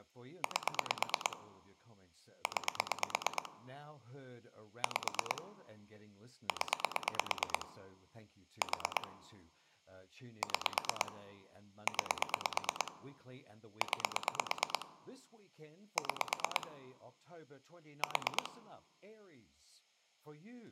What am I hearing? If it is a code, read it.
Pulse dialling, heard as clicks on a phone line, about 9 pulses a second, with speech in English. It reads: 8 9 5 0 4 6 9 9 6 4